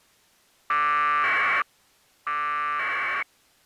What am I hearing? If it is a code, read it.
Packet radio (AX.25, as in APRS), 1200 baud, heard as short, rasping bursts.